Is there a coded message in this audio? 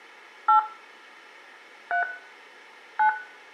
Yes: DTMF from 0.5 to 3.1 s, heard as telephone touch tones, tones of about 120 ms, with room echo. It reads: 8 3 9